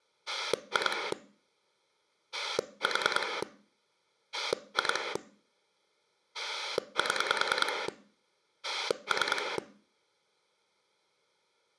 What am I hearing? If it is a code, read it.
Pulse dialling, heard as a rotary dial, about 10 pulses a second. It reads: 2 4 2 7 3